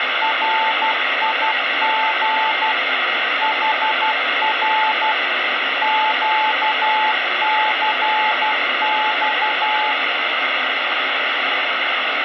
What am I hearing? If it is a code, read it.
Morse code, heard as a keyed tone, machine-sent, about 12 wpm, 870 Hz, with radio static. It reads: RIG HR QCX